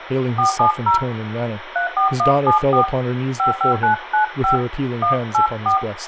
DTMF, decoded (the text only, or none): 470 34174 55995 184